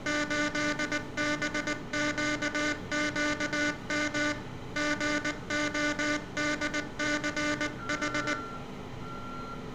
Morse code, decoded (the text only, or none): 8BQQM GODCH